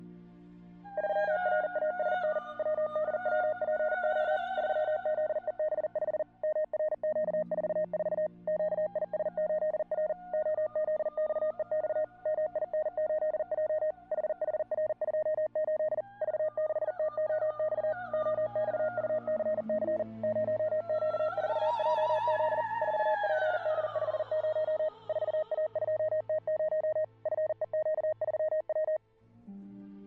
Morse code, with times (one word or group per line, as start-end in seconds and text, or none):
1.0-2.4 3RASN
2.6-4.4 WDWPO
4.6-6.2 3ZEB5
6.4-8.3 MRQ44
8.5-10.1 QIS8R
10.3-12.0 OZXEX
12.3-13.9 MIN8J
14.1-16.0 HHR28
16.2-17.9 V6TOX
18.1-20.0 OXUCC
20.2-22.6 0Q4JZ
22.8-24.9 4PD50
25.1-27.0 4A2T0
27.3-29.0 FEQ3W